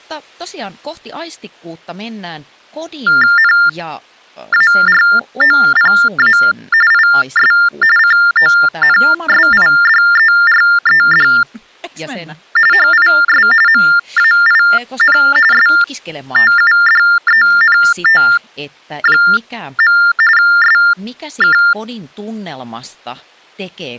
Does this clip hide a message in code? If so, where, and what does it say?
Yes: TTY/TDD text telephone tones (45.45 baud Baudot) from 3.1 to 21.7 s, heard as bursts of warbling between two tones, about 400 Hz shift, 1600 Hz centre, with speech in Finnish. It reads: NAROPA IS CONSIDERED HIS MAIN STUDENT. SK